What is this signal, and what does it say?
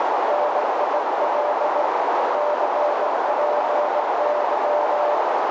Morse code, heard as a keyed tone, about 19 wpm, 590 Hz, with heavy radio static and a narrow filter. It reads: NIL CPY